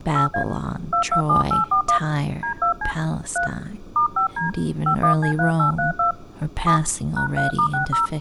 DTMF, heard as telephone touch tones, dialled by hand, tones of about 110 ms, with speech in English. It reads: 8A 227841 D2C 3 *5D 51C3832 7 #3*60